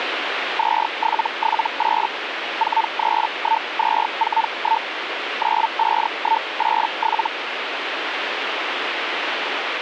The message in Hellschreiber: 2778 431241 95187

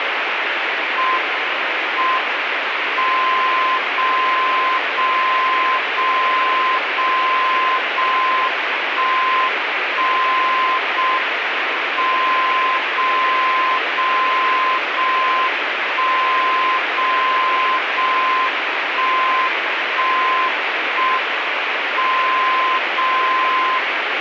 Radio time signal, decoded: M M 0 0 0 0 0 1 1 0 M 0 0 0 1 0 0 1 1 1 M 0 0

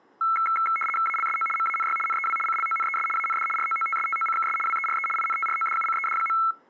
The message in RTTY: ALSO MANY NEW CLONES AND ROOTSTOCKS WERE INTRODUCED.

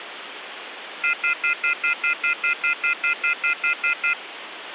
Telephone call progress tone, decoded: off-hook warning tone

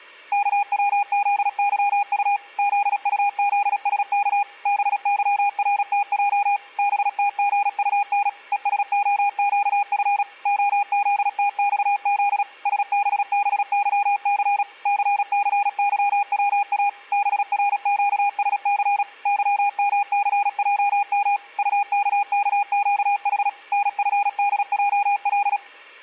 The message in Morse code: KWZYU ZUZSK BYRTJ BTGUN ESOQF OZTXZ SBBYC CCYWA BRQSC YMCJM UKKQH NFDJL

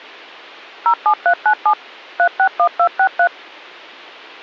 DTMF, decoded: 07397 361263

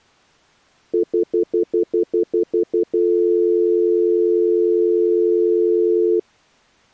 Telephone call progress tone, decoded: stutter dial tone

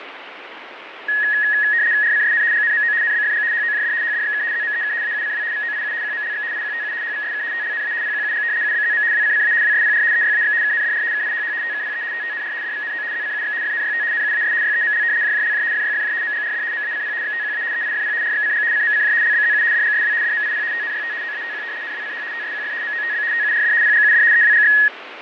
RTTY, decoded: RCSN GNMO NBFG HOJD HDXK ZMEK AUCW VOIU QMLX IQTU HVSK TLNA PQUG UBZM WCCA WSPR EYAX KNDR KIHH TKPE TTNR DVNO ZCUX FNYT NUAS YEML JJLJ FYFJ MGRD MACP XTQA EIFP RXCG CMCJ LBZU DGSW DMIP TNYT OATQ NWCH TSQF MOTB TURD PGUD EWGX

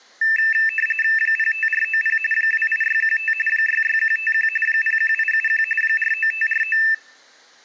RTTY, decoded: 05490 28615 66151 01871 49549

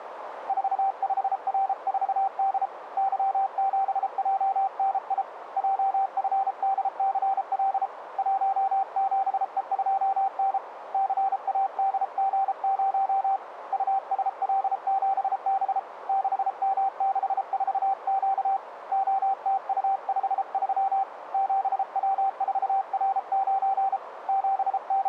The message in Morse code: 45R4D Y7JNI JFDCL 17E2N CADG0 USL7B 6M64Q OTU53 7W4R9 …

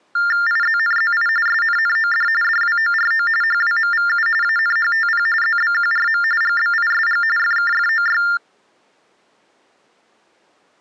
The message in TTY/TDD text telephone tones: IZNZI SNNOD DWORO HWMVU ANHTP ZBQRM GBISG FKFOY

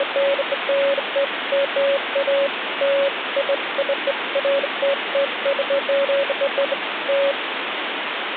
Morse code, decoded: none

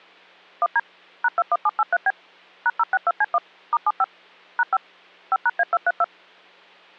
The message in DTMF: 1D #21783B #062C1 *75 #5 5#A232

